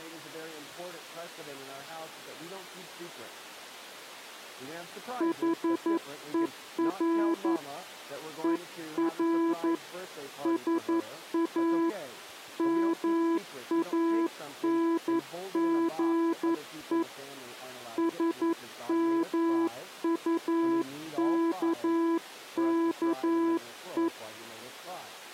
Morse code, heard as a keyed tone, hand-sent with a paddle, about 11 wpm, 330 Hz. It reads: HER ER SA MANGE SMUKKE